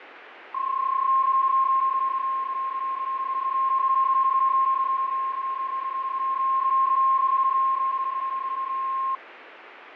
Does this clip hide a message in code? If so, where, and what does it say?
Yes: PSK31 (31.25 baud) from 0.5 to 9.2 s, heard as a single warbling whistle, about 1060 Hz, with radio static.